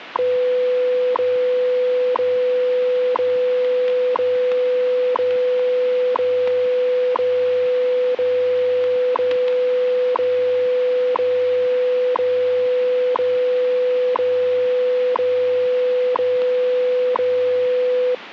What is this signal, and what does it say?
Radio time signal (WWV, Colorado), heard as ticks, one a second, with radio static and static crashes.